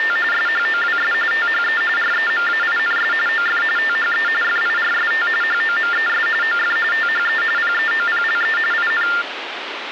TTY/TDD text telephone tones (45.45 baud Baudot), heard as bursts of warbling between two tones, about 400 Hz shift, 1600 Hz centre, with phone line noise. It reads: … SHOWS THE REMAINS OF THE FIRST HOMES OF THE PEOPLE IN